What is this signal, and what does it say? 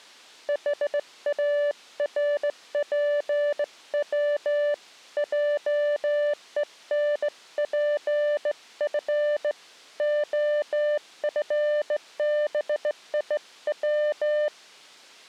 Morse code, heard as a keyed tone, hand-sent with a straight key, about 16 wpm, 590 Hz. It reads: HARPW JENPF OFBIW